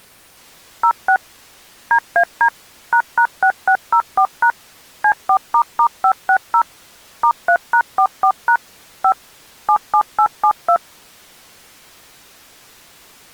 DTMF, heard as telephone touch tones, dialled by machine, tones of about 80 ms. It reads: 06 DAD ##6604# C4**560 *3#44# 5 77872